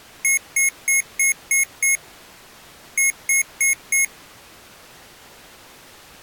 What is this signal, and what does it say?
Beep code, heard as beeps from a small speaker, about 2150 Hz. 6-4.